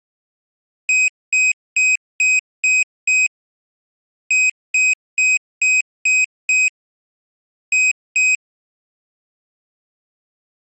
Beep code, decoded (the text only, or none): 6-6-2